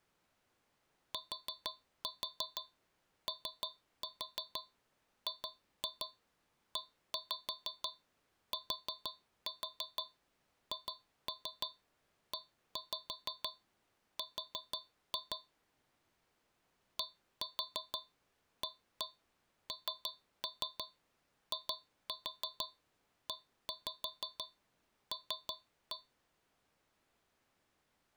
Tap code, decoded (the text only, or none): TOGETHER DANIEL